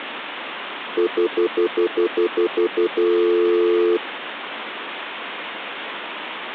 Telephone call progress tone (North American plan), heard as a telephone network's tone, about 350, 440 Hz, 0.1 s on and 0.1 s off, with phone line noise. Stutter dial tone.